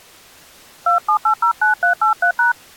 DTMF, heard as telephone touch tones, dialled by hand, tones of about 110 ms. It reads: 27809383#